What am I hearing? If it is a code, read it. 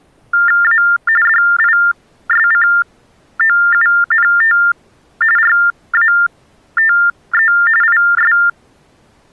TTY/TDD text telephone tones (45.45 baud Baudot), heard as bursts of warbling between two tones, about 400 Hz shift, 1600 Hz centre. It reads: A DISCOUNT RATE IS